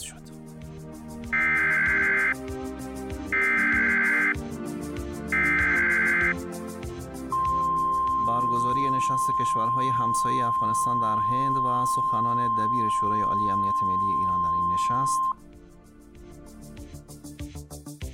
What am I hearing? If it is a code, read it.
Emergency Alert System (SAME) tones (header bursts, then the 1050 Hz attention tone), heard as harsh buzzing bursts, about 520.83 baud.